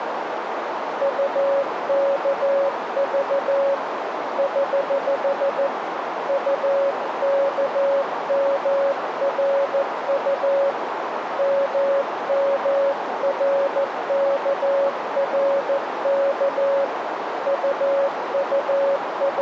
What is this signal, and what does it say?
Morse code, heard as a keyed tone, hand-sent with a paddle, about 14 wpm, 560 Hz, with radio static and a narrow filter. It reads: UKV <HH> UKMRU MMRKRK …